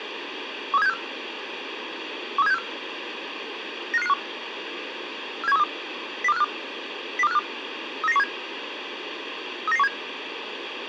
Five-tone selective call (EEA), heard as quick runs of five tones, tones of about 40 ms, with radio hiss. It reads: 13764 13764 95551 47132 02452 02452 39917 39917